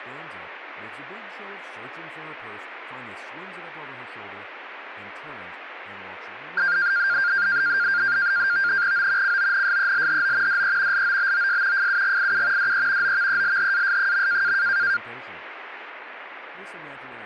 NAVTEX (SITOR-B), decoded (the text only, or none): O CONSELHO DE LOBOS FUGIU DE OVELHAS.